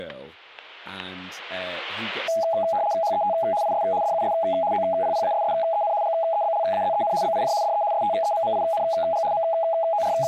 RTTY (75 baud, 170 Hz shift), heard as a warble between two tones, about 740 Hz centre, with static crashes and speech in English. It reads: HET IS DUS OPPASSEN GEBLAZEN BIJ DE STEMMING …